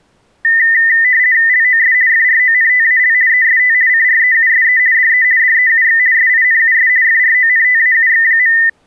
RTTY (50 baud, 170 Hz shift), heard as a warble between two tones, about 1900 Hz centre. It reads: LOS FRONTAL EST CREUSE DE DEUX SINUS FRONTAUX.